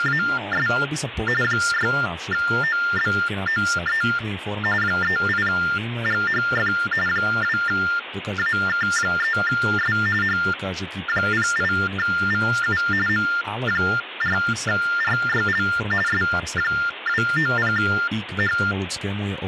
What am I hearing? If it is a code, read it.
TTY/TDD text telephone tones (45.45 baud Baudot), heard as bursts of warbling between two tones, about 400 Hz shift, 1600 Hz centre, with phone line noise and speech in Slovak. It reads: … 6OBOE 38GHF 2AK3S H08VU M4RYL S290H